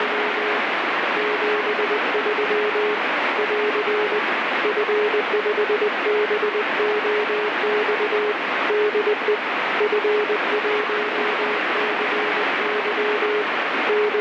Morse code, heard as a keyed tone, hand-sent with a paddle, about 20 wpm, 420 Hz, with heavy radio static. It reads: … 73 <AR> F5BOX DE F1CY …